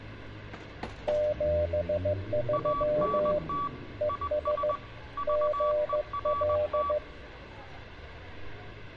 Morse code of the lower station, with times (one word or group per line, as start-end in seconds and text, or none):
1.1-3.4 73
4.0-4.7 ES
5.3-7.0 GL